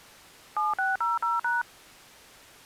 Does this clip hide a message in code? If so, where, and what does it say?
Yes: DTMF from 0.6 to 1.6 s, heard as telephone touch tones, dialled by machine, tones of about 170 ms. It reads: 7600#